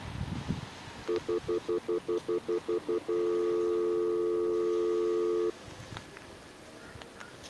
Telephone call progress tone (North American plan), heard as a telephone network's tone, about 350, 440 Hz, 0.1 s on and 0.1 s off, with the noise of a residential street. Stutter dial tone.